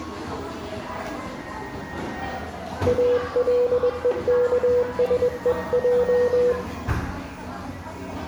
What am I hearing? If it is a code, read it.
Morse code (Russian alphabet), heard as a keyed tone, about 21 wpm, 490 Hz, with room echo and the noise of a crowd indoors. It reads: АЛЕКСЕЙ